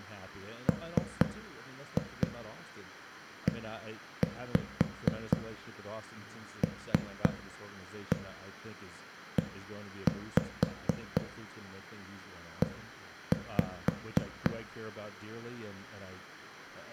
Tap code, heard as knocks on a wall, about 4 knocks a second, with room echo and speech in English. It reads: MELEE